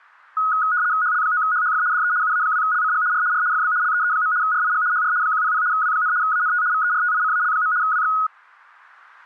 RTTY (75 baud, 170 Hz shift), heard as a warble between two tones, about 1360 Hz centre. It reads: HL9HHF DE UA2LCG R R FB LEE. RIG HR 100 W, ANT VERTICAL. WX